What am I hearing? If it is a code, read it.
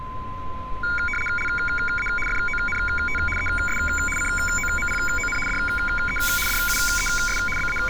RTTY (75 baud, 850 Hz shift), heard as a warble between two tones, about 1850 Hz centre, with a steady whistle near 1030 Hz and street noise. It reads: LA FONT ES COMPON DE DUES …